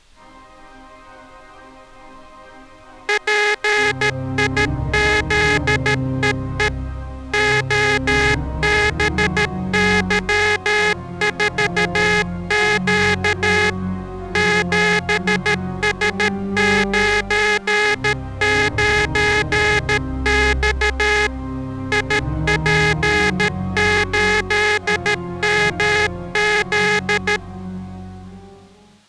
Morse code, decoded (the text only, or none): PIZEE OBY4Q 7S99X IP8MZ